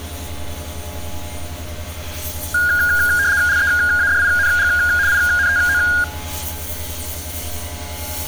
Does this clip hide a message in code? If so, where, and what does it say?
Yes: RTTY (75 baud, 170 Hz shift) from 2.5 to 6.0 s, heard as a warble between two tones, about 1550 Hz centre, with street noise. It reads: LEADING INTO